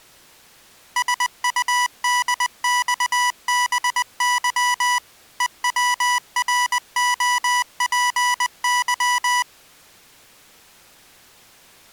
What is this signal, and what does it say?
Morse code (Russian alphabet), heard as electronic beeps, machine-sent, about 20 wpm, 980 Hz. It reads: СУДЬБЫ ЕВРОПЫ